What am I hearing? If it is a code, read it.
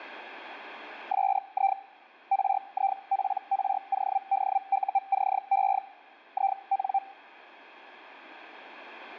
Hellschreiber (Feld-Hell, 122.5 baud), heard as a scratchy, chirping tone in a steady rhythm, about 780 Hz. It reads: SI RIPRODUCE IN